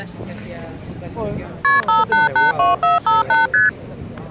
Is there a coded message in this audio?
Yes: multi-frequency trunk signalling (R1, as on North American trunks) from 1.6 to 3.7 s, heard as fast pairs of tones, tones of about 160 ms. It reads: KP 5882458 ST